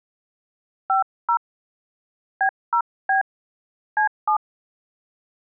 DTMF, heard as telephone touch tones, dialled by hand, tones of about 100 ms. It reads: 50 B0B C7